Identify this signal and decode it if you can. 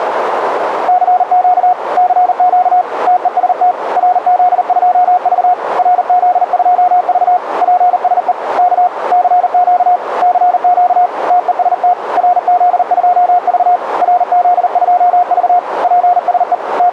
Morse code, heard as a keyed tone, hand-sent with a paddle, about 39 wpm, 720 Hz, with radio static and a narrow filter. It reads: CQ CQ TEST RZ2V RZ2V PSE K CQ CQ TEST RZ2V RZ2V PSE …